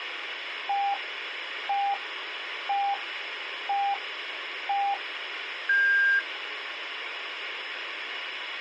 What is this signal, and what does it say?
Radio time signal (five pips and a higher one, as on Chinese radio), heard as pips, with radio hiss.